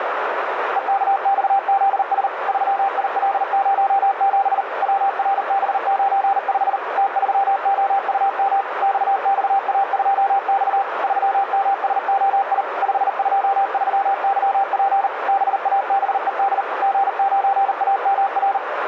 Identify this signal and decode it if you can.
Morse code, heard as a keyed tone, machine-sent, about 39 wpm, 790 Hz, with radio static and a narrow filter. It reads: EKXZS 3IL07 WRB95 T3OUM XXA2X 3MSOI 523YP BABED G9AMR